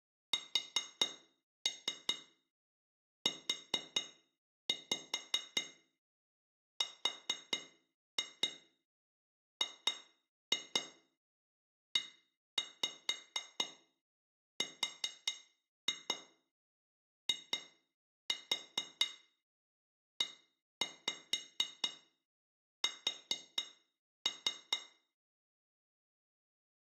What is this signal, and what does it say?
Tap code, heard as taps on glass, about 4 knocks a second, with room echo. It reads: SURGERIES